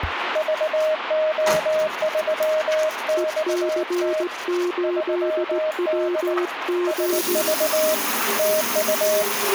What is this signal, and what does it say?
Morse code, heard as two keyed tones, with radio static and the noise of a restroom. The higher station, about 19 wpm, 620 Hz: VO3XT 3D SV TU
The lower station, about 17 wpm, 350 Hz: EC8WG